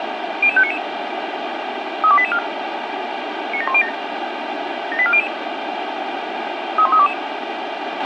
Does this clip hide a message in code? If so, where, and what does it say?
Yes: five-tone selective call (ZVEI) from 0.4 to 7.1 s, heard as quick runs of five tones, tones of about 70 ms, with radio hiss and a squelch burst at the end. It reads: 00599 32884 97107 78400 31322